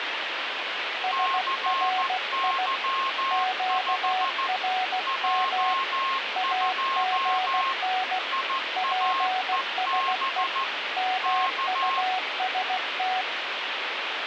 Morse code, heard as two keyed tones, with radio static. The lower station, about 16 wpm, 740 Hz: SRI QRM AGN PSE MUST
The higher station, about 14 wpm, 1070 Hz: CY5 J2 IAEB K